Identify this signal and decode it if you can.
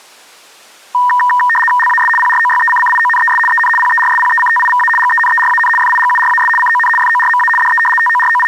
RTTY (75 baud, 850 Hz shift), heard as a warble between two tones, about 1410 Hz centre. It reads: LAS PROYECCIONES EN PERSPECTIVA GENERAN FIGURAS CON FORMA DE …